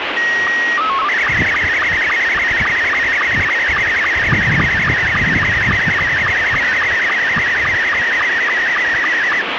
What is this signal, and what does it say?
SSTV (slow-scan television), Scottie S2, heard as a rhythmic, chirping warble, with radio static and the noise of a park.